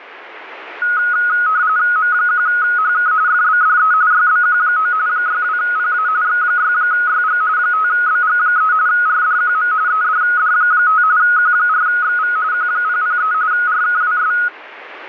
RTTY (45.45 baud, 170 Hz shift), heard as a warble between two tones, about 1360 Hz centre. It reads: M1HK FBDE YBQ9 62PA X6YG 5BG3 RDQM EDD5 Q4XV Q003 RKWS